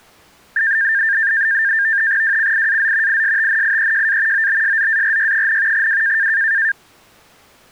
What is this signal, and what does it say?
NAVTEX (SITOR-B), 100 baud, 170 Hz shift, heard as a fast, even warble, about 1700 Hz centre. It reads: WCIAZ ISTNIEJA OBSZARY, W